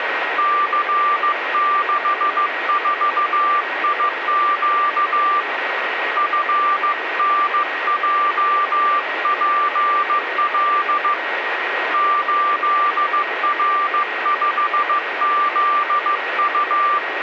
Morse code, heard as a keyed tone, hand-sent with a paddle, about 15 wpm, 1180 Hz, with radio static and a steady whistle near 1890 Hz. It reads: C64IQ FNJPL 8R5ZU